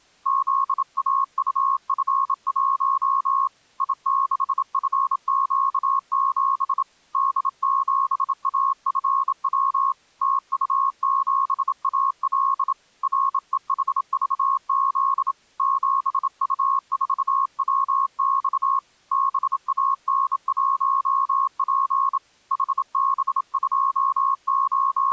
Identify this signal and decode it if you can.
Morse code, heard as a keyed tone, hand-sent with a bug key, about 27 wpm, 1090 Hz. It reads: ZAUF1 I6FQ7 D7AFW TU7AL REHVZ 7U4WX BAN1P …